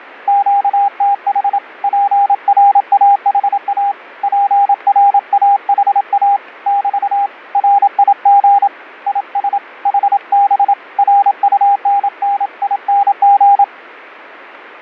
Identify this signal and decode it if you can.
Morse code, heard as a keyed tone, hand-sent with a paddle, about 27 wpm, 800 Hz. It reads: QTH PRAHA PRAHA <BT> RIG IS HB RUNNING